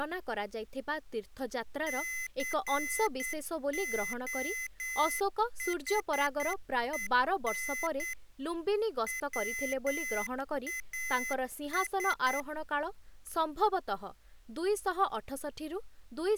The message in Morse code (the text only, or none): COHEN WAS